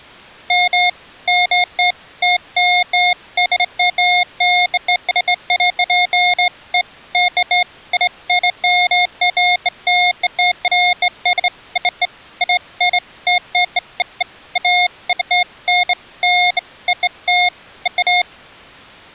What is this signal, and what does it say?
Beeps of irregular length. There is no code.